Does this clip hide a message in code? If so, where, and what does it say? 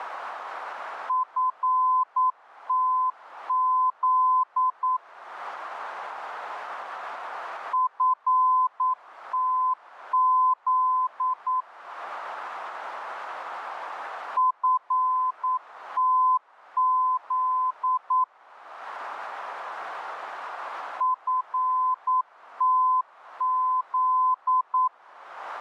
Yes: Morse code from 1.0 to 24.9 s, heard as a keyed tone, machine-sent, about 9 wpm, 1020 Hz. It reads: FTZ FTZ FTZ FTZ